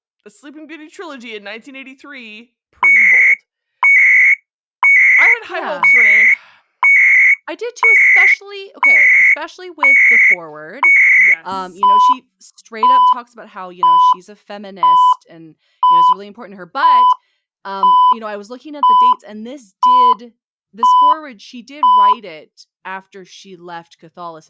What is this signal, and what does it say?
Radio time signal (CHU, Canada), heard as beeps and data bursts, one a second, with speech in English.